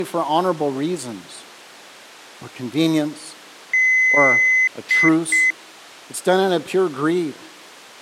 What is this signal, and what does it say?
Beep code, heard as beeps, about 2050 Hz, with speech in English. 1 long, 2 short. In Award, IBM and AMI BIOS tables: video adapter failure.